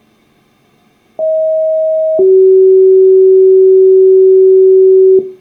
Two-tone page, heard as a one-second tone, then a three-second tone, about 630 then 380 Hz.